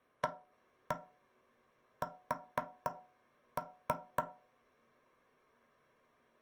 Tap code, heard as knocks on wood, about 3 knocks a second. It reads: AS